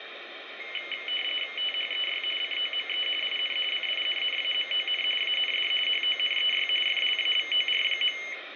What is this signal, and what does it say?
RTTY (45.45 baud, 850 Hz shift), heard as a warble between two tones, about 2550 Hz centre, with radio static. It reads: THEY COME IN CINNAMON AND HONEY FLAVOR.